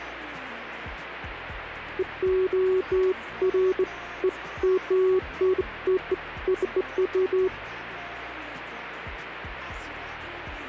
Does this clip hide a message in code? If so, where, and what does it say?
No, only beeps of irregular length, with radio static.